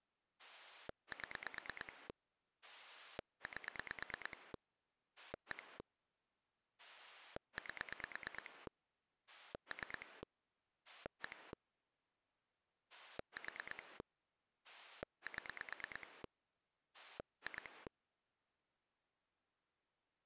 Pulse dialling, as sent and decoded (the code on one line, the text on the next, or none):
7 / 8 / 1 / 8 / 3 / 1 / 4 / 7 / 2
7 8 1 8 3 1 4 7 2